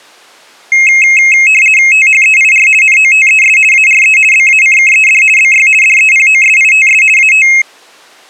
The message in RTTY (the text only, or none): THEIR NOTES ARE BACKED BY DEPOSITS AT